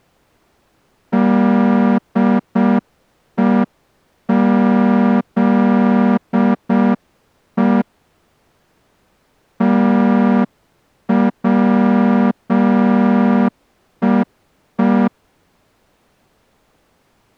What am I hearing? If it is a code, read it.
Morse code, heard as a horn, hand-sent with a straight key, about 6 wpm. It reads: DEZE TWEE